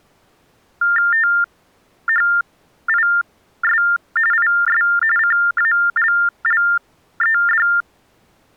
TTY/TDD text telephone tones (45.45 baud Baudot), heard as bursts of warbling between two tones, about 400 Hz shift, 1600 Hz centre. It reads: THIS IS CALLED